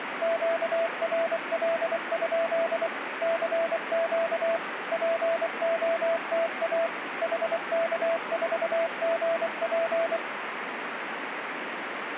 Morse code, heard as a keyed tone, machine-sent, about 24 wpm, 660 Hz, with radio static. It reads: QRL? CQ POTA HK4GP